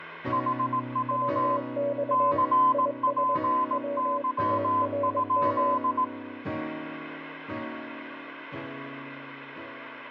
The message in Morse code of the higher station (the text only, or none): HW CPY?